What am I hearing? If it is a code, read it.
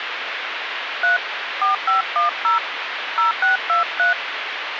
DTMF, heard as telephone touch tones, dialled by hand, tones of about 130 ms, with phone line noise. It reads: 3 4510 0623